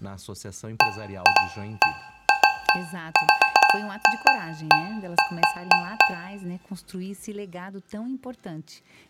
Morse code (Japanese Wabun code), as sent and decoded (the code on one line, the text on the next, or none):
none